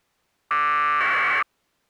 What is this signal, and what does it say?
Packet radio (AX.25, as in APRS), 1200 baud, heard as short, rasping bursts.